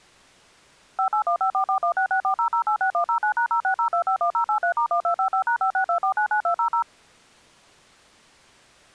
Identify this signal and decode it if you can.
DTMF, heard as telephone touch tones, dialled by machine, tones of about 90 ms. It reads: 58154416640086109#060251083*1255#562499200